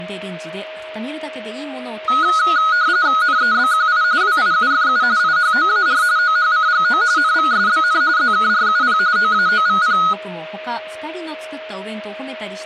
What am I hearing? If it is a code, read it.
RTTY (45.45 baud, 170 Hz shift), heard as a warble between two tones, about 1360 Hz centre, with a steady whistle near 630 Hz and speech in Japanese. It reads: NEBQI WIUFU IHOAR OHCGO NVSBN ZKRUP OAOVP